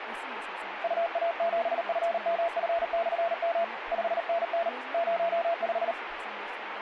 Morse code, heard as a keyed tone, hand-sent with a paddle, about 38 wpm, 680 Hz, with radio static and speech in English. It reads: UA7FMF/M 5NN 05